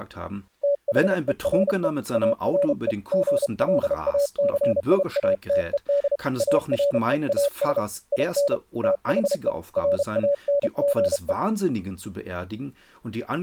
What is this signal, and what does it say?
Morse code, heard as a keyed tone, hand-sent with a paddle, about 32 wpm, 570 Hz, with speech in German. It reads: THERE ARE GLACIATED AREAS IN THE RANGE